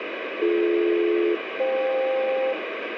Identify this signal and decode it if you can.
Aircraft SELCAL, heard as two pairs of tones, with radio static and room echo. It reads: BD-FK